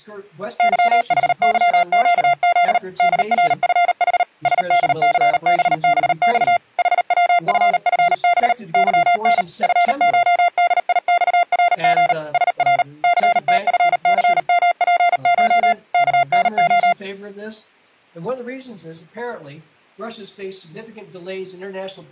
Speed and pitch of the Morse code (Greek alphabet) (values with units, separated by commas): 38 wpm, 700 Hz